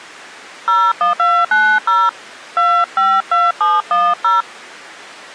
DTMF, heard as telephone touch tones, dialled by hand, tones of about 200 ms. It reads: 01290 252710